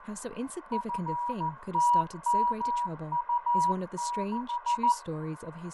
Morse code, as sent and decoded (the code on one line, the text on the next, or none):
..-. - -- ..- -....
FTMU6